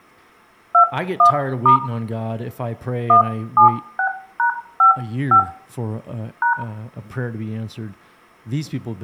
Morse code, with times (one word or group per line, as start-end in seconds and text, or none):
none